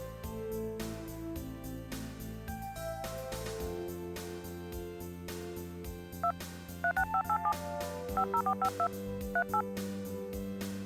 DTMF, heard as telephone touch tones, dialled by hand, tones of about 70 ms. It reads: 2 36587 50452 38